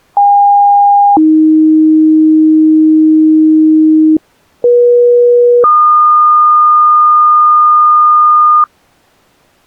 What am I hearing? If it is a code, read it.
Two-tone page, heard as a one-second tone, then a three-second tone, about 810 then 310 Hz, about 480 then 1220 Hz.